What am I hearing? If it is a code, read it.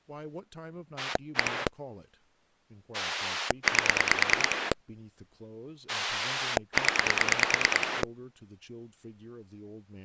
Pulse dialling, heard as a rotary dial, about 9 pulses a second, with speech in English. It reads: 1 8 0